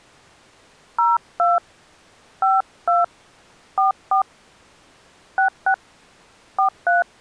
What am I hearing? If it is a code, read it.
DTMF, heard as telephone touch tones, dialled by hand, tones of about 130 ms. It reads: 02 52 44 66 43